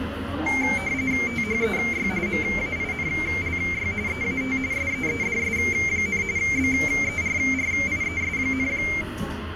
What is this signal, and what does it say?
RTTY (45.45 baud, 170 Hz shift), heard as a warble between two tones, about 2200 Hz centre, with radio static and the noise of a restaurant. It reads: THEY MAINLY EAT SEEDS, BERRIES,